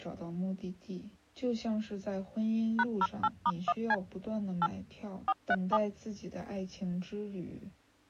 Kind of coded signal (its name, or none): DTMF